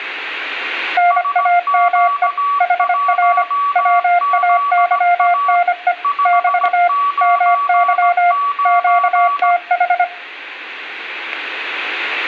Morse code, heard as two keyed tones, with static crashes and room echo. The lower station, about 25 wpm, 700 Hz: NAME HR WAYNE <BT> MY QTH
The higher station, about 17 wpm, 1140 Hz: SQ1ZA 599